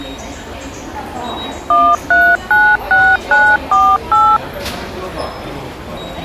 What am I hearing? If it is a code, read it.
DTMF, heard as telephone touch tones, dialled by machine, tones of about 250 ms, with the noise of a subway station. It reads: 1396948